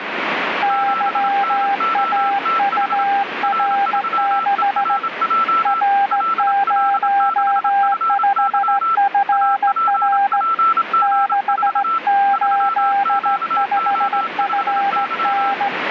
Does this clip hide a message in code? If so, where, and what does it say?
Yes: Morse code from 0.6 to 15.7 s, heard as two keyed tones, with radio static. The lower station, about 16 wpm, 800 Hz: YAUR6 R05FR 685FN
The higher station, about 27 wpm, 1330 Hz: 7NOTH R3ERJ LL6FY APPG4 3QO5Y